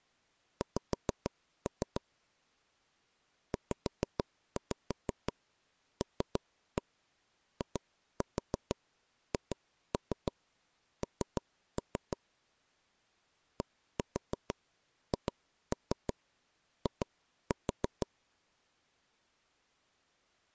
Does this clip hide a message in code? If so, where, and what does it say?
Yes: tap code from 0.6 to 18.1 s, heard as taps on a table, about 6 knocks a second. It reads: X ZLIHN DHI